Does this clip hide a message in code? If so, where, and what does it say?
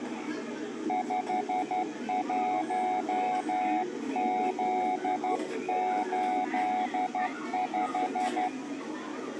Yes: Morse code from 0.8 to 8.5 s, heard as a keyed tone, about 12 wpm, 740 Hz, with room echo and the noise of a park. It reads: 51Z85